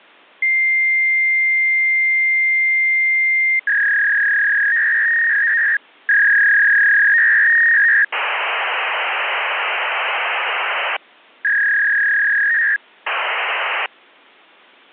Fax machine handshake, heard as a long tone, a warble and hiss.